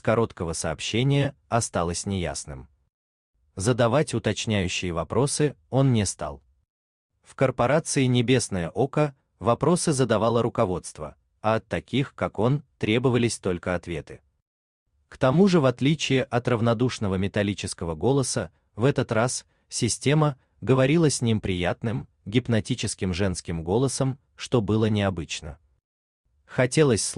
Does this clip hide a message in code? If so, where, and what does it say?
No.